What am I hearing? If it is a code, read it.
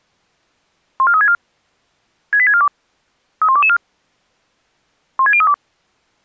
Five-tone selective call (ZVEI), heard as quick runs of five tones, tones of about 70 ms. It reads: 14364 68642 31224 16032